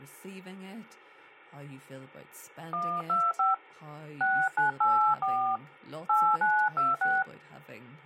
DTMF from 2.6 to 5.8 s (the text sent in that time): 125 6984